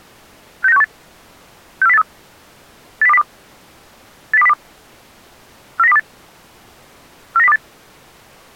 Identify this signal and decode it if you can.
Five-tone selective call (EEA), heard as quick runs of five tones, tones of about 40 ms. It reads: 69618 64083 80202 80202 49028 49028